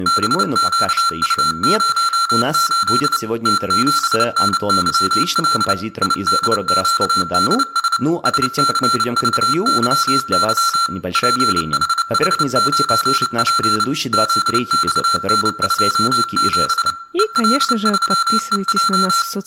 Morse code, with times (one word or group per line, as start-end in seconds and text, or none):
0.1-3.2 BQU08
3.5-5.7 T7NYL
6.0-8.0 IDQDS
8.3-10.9 SCVYY
11.1-13.8 PHH9P
14.1-16.9 ZXN27
17.2-19.2 EL3EJ